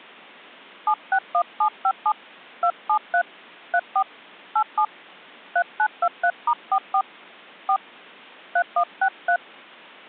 DTMF, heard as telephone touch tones, dialled by hand, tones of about 70 ms. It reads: 761757 273 34 87 3923*44 4 3163